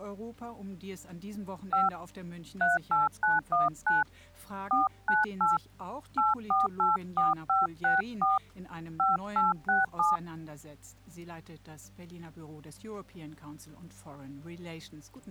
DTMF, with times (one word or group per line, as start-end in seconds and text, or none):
1.7-1.9 5
2.6-4.0 38919
4.7-5.6 498
6.2-8.4 8484564
9.0-10.2 5867